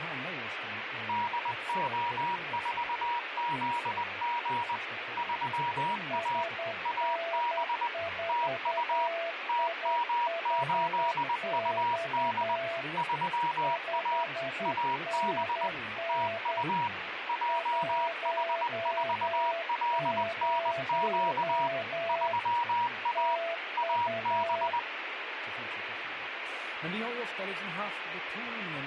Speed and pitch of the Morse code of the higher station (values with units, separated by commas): 20 wpm, 950 Hz